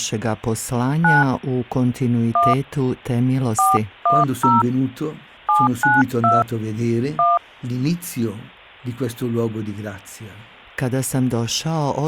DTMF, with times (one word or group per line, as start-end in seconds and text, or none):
1.0-1.2 9
2.4-2.5 1
3.6-4.6 410
5.5-6.4 792
7.2-7.4 1